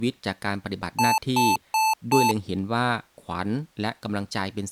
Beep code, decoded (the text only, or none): 4 short